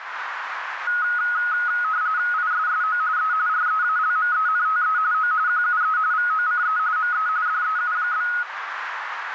RTTY (45.45 baud, 170 Hz shift), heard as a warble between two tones, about 1360 Hz centre, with radio static and a narrow filter. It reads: ISSO E REALMENTE O QUE VOCE ME DEU?